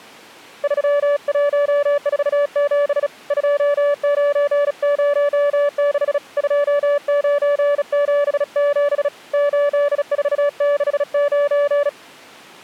Morse code, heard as a keyed tone, hand-sent with a bug key, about 36 wpm, 580 Hz. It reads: 3147 2906 2977 8469